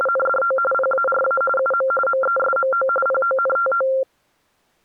RTTY (45.45 baud, 850 Hz shift), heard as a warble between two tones, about 950 Hz centre. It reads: … PARA UM MESMO PONTO